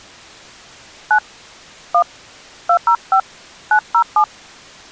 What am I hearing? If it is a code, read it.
DTMF, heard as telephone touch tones, dialled by hand, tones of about 80 ms. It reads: 9 1 205 907